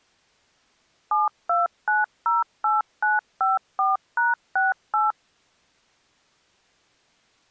DTMF, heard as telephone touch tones, dialled by machine, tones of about 170 ms. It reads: 72908954#68